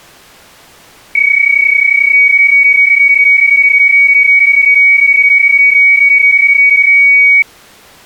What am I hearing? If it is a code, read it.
PSK31 (31.25 baud), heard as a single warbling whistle, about 2250 Hz.